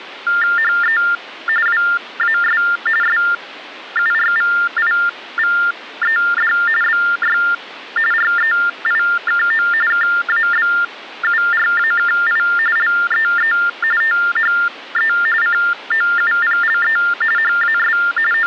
TTY/TDD text telephone tones (45.45 baud Baudot), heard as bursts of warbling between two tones, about 400 Hz shift, 1600 Hz centre. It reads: HE WAS SURVIVED BY REIKO KABURAKI LEE THE COUPLE HAS …